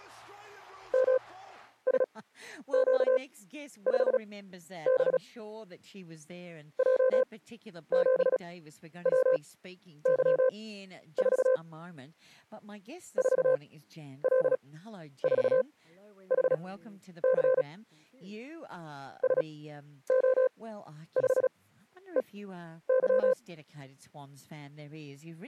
Morse code, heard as a keyed tone, machine-sent, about 36 wpm, spaced as for 11 wpm, 520 Hz. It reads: MSQ5B J7WY4 4L4HC SO5EY